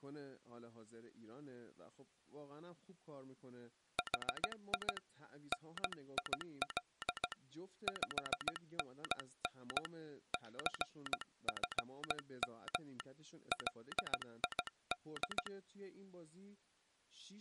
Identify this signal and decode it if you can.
Morse code, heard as a telegraph sounder, hand-sent with a paddle, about 16 wpm, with speech in Persian. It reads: HI NIL 5NN CFM LID